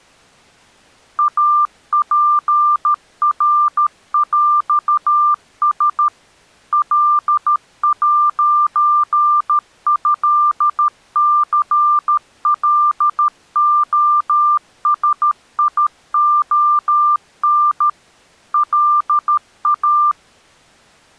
Morse code (with French letters), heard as a keyed tone, machine-sent, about 13 wpm, 1190 Hz. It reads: APRÈS L'ÉCLOSION LA